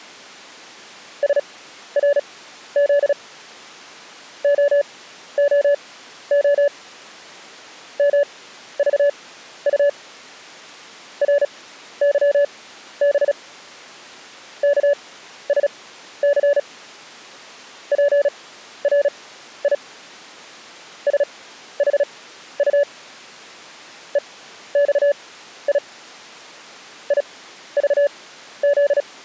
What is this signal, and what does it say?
Morse code, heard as a keyed tone, machine-sent, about 36 wpm, spaced as for 13 wpm, 570 Hz. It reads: SRZ OOO MVU RYB KSC PRI SHU EXI IVZ